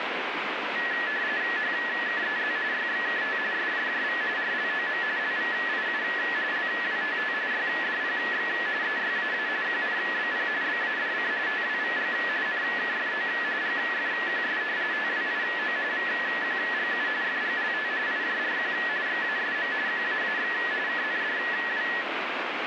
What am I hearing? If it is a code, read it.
RTTY (45.45 baud, 170 Hz shift), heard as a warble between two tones, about 1800 Hz centre, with radio static. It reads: HKEZ YXKT SJJV RLOM LVIU LWTT YDPX EYAA QNBP BADC TWVG NKFO GFQS TWIO VQGU FGLT IJRQ XASM QAAX KNDW